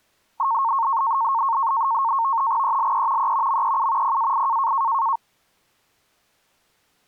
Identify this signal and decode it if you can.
NAVTEX (SITOR-B), 100 baud, 170 Hz shift, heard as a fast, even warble, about 1000 Hz centre. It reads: ELE E MEU PAI